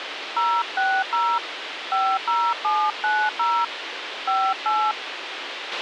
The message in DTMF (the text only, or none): 060 50790 58